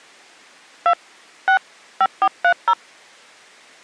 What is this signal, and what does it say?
DTMF, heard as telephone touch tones, dialled by hand, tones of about 70 ms. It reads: 2 6 5430